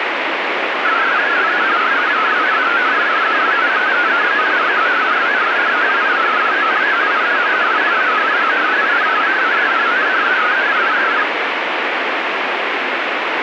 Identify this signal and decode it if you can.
Multi-tone FSK (Olivia or MFSK type), about 500 Hz wide, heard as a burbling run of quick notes, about 62.5 baud, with radio static.